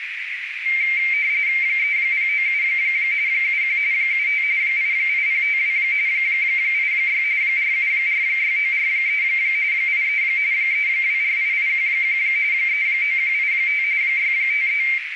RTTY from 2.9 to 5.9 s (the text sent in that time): 71 75 88052